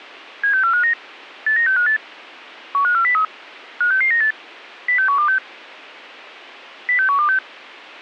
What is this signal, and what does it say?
Five-tone selective call (CCIR), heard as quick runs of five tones, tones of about 100 ms. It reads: 76459 89658 15403 56698 06126 06126